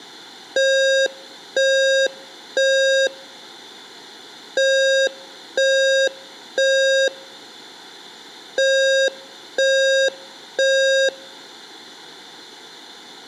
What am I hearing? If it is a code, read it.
Alarm pattern, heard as an alarm's beeps, played three times, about 540 Hz, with room echo. Temporal three. Smoke or fire, evacuate.